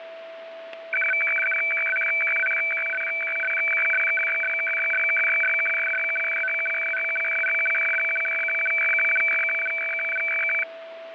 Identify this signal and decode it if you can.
Weather fax (radiofax), 120 lines a minute, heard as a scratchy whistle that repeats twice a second, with radio static and a steady whistle near 660 Hz.